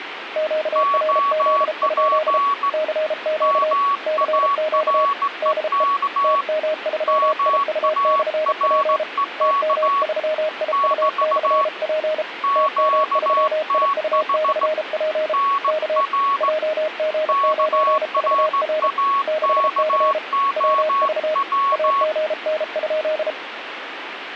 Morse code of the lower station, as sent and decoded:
--.- .-. --.. ..--.. / -.-. --.- / -.-. --.- / -.. . / - -- ...-- .. ..- -..-. .--. / - -- ...-- .. ..- -..-. .--. / - -- ...-- .. ..- -..-. .--. / -.- / .--- --. ----. ...- .-. / -.... -.-. / .-- ...- / .- --. -. ..--..
QRZ? CQ CQ DE TM3IU/P TM3IU/P TM3IU/P K JG9VR 6C WV AGN?

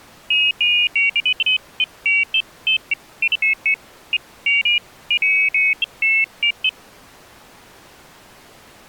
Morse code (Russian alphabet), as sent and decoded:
none

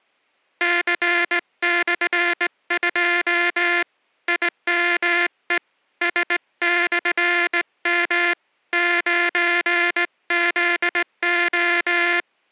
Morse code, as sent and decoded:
-.-. -..-. ..--- / .. -- . / ... -..-. -- / ----. --.. ---
C/2 IME S/M 9ZO

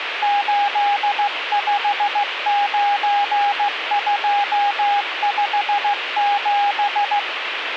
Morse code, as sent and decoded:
---.. ..... ----. ..--- ..... --...
859257

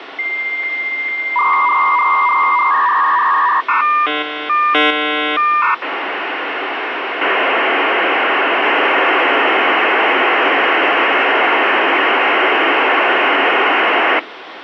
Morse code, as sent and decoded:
none

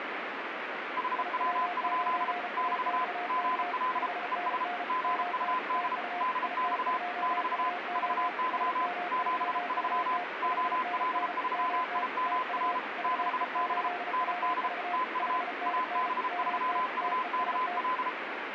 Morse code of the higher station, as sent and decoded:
.... .-- ..--.. / -...- / --. .-.. / . ... / --. ..- -.. / -.. -..- / -...- / ...- -.-- / --... ...-- / --- .-.. ...-- .. -- .-. / -.... -... / -. -.. / - ..- / .- -... ...-- ..- -.- .-..
HW? <BT> GL ES GUD DX <BT> VY 73 OL3IMR 6B ND TU AB3UKL

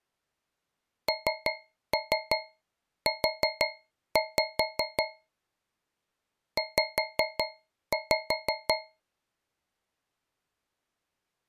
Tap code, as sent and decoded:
3-3 4-5 / 5-5
NU Z

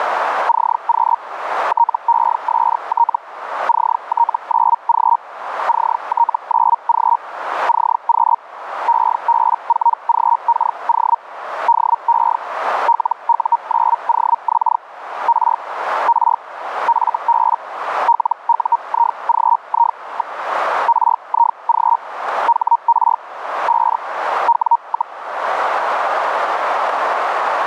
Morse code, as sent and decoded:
none

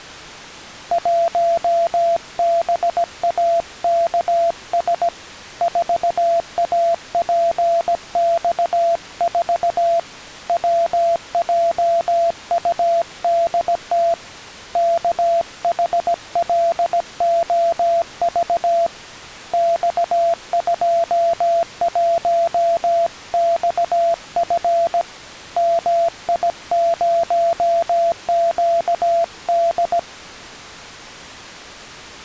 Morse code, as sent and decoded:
.---- -... .- -.- ... / ....- .- .--. -..- ....- / .-- .--- ..- -.. - / -.- .... .-.. --- ...- / -..- ..--- .---- -..- ..-. / -- .. ----- --.- -..
1BAKS 4APX4 WJUDT KHLOV X21XF MI0QD

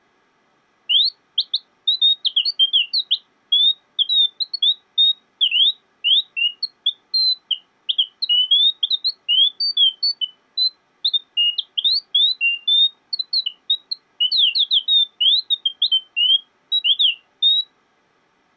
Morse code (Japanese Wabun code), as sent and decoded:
none

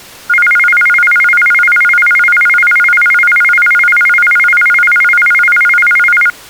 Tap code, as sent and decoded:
none

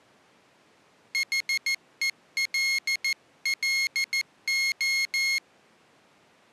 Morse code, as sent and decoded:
.... . .-.. .-.. ---
HELLO

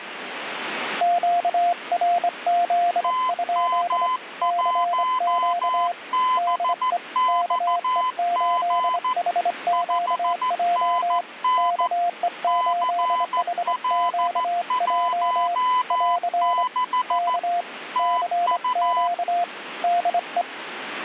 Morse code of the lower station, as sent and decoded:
--.- .-. --.. ..--.. / -.-. --.- / -.. . / -.- . ---.. .... --.- .--- / -.- . ---.. .... --.- .--- / .-.-. / -.- / -.-. --.- / -.. .
QRZ? CQ DE KE8HQJ KE8HQJ <AR> K CQ DE

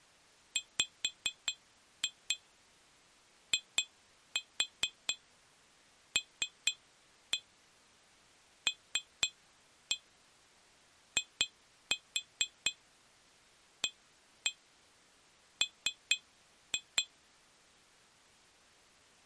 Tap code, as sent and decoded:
5-2 2-4 3-1 3-1 2-4 1-1 3-2
WILLIAM

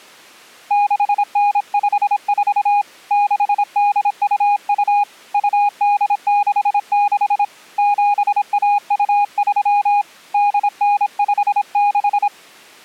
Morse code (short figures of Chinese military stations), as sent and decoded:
-.... -. ..... ....- / -.... -.. ..- ..- / ..- -.. -.... -.... / --... .- ..- ...-- / -.. -. ..... -....
6954 6822 2866 7123 8956

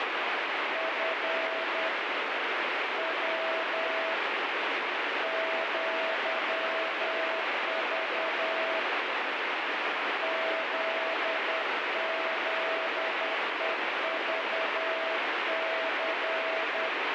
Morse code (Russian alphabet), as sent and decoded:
..-. / .-- / --.-- ...- / --.. --.. . ...- -.-.
Ф В ЪЖ ЗЗЕЖЦ

